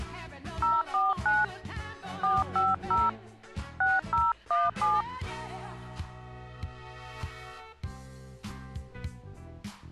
DTMF, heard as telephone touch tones, dialled by hand, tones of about 190 ms. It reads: 049 450 6017